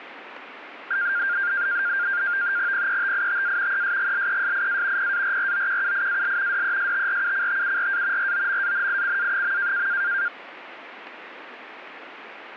NAVTEX (SITOR-B), 100 baud, 170 Hz shift, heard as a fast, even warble, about 1500 Hz centre, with radio static. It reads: PETITA ESGLESIA PARROQUIAL DESTRUCTURA ROMANICA.